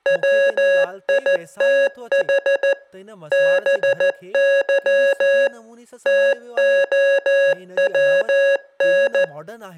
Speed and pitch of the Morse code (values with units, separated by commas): 14 wpm, 550 Hz